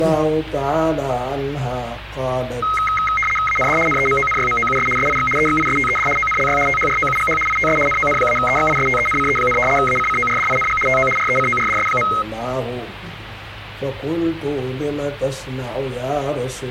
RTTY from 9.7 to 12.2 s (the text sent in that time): ACCORDING TO RECORDS.